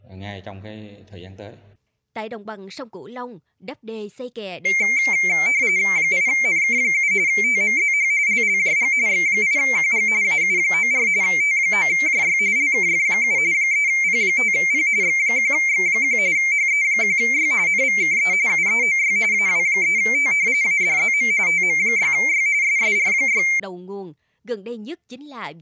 RTTY (45.45 baud, 170 Hz shift), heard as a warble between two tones, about 2200 Hz centre, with speech in Vietnamese. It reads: 8NK7 TMZH LLJG X8QG AU94 T9JY LKF7 3P5P X1X1 HE1Y NVKE UEOY AW3T ADZM TM6Y SSR6